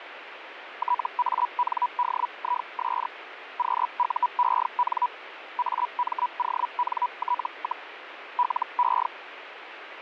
Hellschreiber (Feld-Hell, 122.5 baud), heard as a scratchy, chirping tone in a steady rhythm, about 980 Hz, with radio static. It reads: TANDIS QUEN AMONT, LE